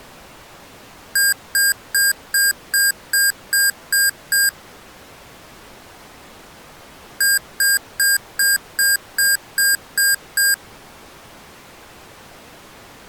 Beep code, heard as beeps from a small speaker, played twice, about 1600 Hz. 9 short. In AMI BIOS tables: ROM checksum failure.